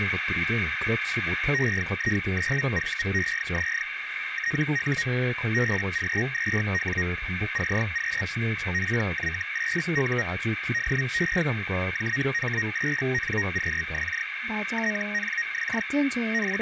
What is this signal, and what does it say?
Hellschreiber (Feld-Hell, 122.5 baud), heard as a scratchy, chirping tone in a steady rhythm, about 1850 Hz, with radio static, a narrow filter and speech in Korean. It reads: EI9VEZ TU BG2W CQ PY8U DE JH8NQX TNX …